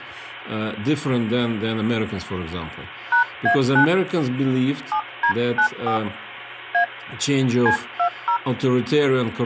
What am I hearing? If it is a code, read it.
DTMF, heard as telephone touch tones, dialled by hand, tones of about 100 ms, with phone line noise and speech in English. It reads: #A9 7D94 A C20